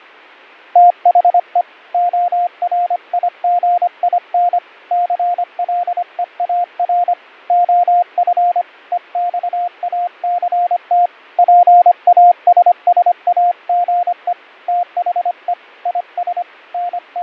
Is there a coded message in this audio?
Yes: Morse code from 0.7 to 17.2 s, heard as a keyed tone, hand-sent with a paddle, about 25 wpm, 710 Hz, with fading. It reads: THE ORIGIN CLEAR OF EXACT PASSAGE THE IS …